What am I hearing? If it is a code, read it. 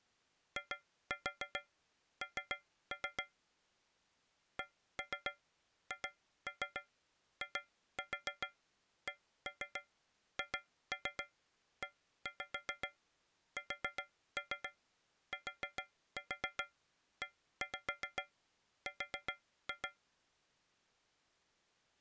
Tap code, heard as taps on a metal pipe, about 7 knocks a second. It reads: IN CHICHESTER